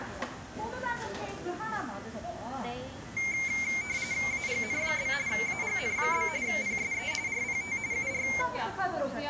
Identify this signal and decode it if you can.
RTTY (45.45 baud, 170 Hz shift), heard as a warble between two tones, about 2200 Hz centre, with the noise of a crowd indoors. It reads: AGN? AGN? PSE RPT UR